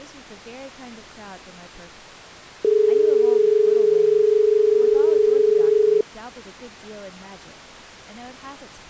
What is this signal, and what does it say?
Telephone call progress tone (as in Australia), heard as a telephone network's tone, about 430 Hz, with speech in English. Dial tone.